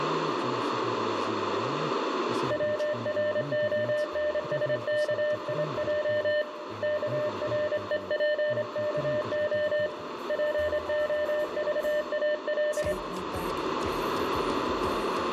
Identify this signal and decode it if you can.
Morse code (Russian alphabet), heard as a keyed tone, hand-sent with a straight key, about 25 wpm, 600 Hz, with radio static, a narrow filter and room echo. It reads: ВРОНСКИЙ КРЕПКО ПОЖАЛ